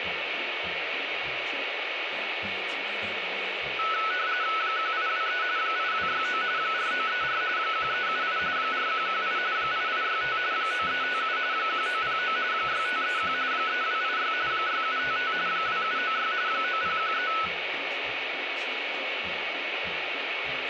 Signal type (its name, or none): RTTY